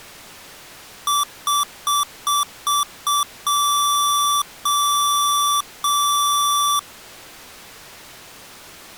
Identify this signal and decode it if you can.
Beep code, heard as beeps from a small speaker, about 1160 Hz. 6 short, 3 long.